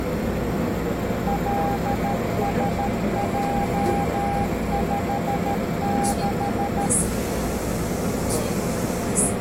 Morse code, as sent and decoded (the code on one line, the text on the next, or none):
.-.. ... .--- ..... -....
LSJ56